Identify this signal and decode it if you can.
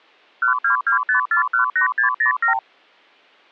Multi-frequency trunk signalling (R2, with the far end's replies), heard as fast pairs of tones, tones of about 110 ms. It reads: 1225418607